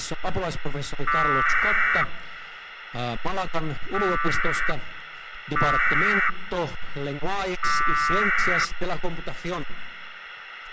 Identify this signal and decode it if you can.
Packet radio (AX.25, as in APRS), 1200 baud, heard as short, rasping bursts, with radio hiss.